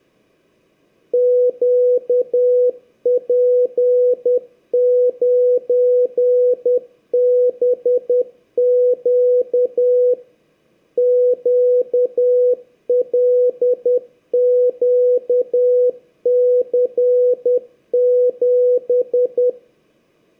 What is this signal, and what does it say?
Morse code, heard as a keyed tone, machine-sent, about 10 wpm, 500 Hz, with room echo. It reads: QP9BQ QLQC7